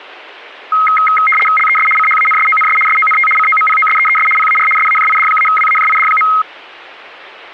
RTTY (75 baud, 850 Hz shift), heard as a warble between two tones, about 1700 Hz centre. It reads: LES CHANSONS SONT COMPOSEES PAR SAJID-WAJID.